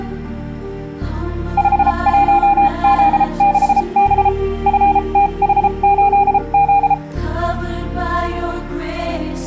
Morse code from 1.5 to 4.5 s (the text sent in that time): 51Z6B